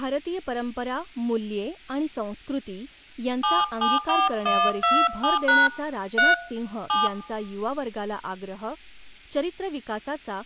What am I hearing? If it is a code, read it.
DTMF, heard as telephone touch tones, dialled by hand, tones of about 200 ms, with speech in Marathi. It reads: 774127# 3 7